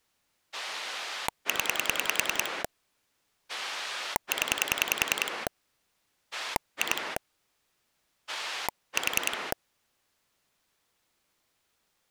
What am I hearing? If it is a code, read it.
Pulse dialling, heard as a rotary dial, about 10 pulses a second. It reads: 0 0 2 4